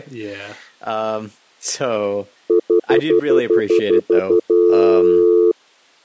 Telephone call progress tone (North American plan), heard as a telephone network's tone, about 350, 440 Hz, 0.1 s on and 0.1 s off, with speech in English. Stutter dial tone.